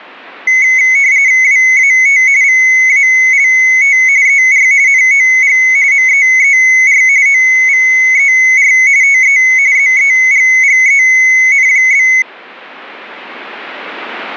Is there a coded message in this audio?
Yes: RTTY (45.45 baud, 170 Hz shift) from 0.5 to 12.2 s, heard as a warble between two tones, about 2150 Hz centre. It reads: WAT VALT ER NOG MEER OVER TE ZEGGEN?